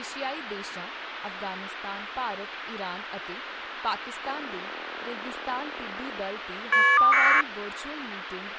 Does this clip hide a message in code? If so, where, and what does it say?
Yes: caller ID data burst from 4.2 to 7.4 s, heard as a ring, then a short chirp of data, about 1200 baud, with phone line noise and speech in Punjabi.